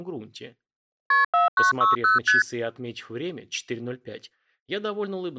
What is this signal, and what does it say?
Multi-frequency trunk signalling (R1, as on North American trunks), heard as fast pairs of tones, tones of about 150 ms. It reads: KP 4960 ST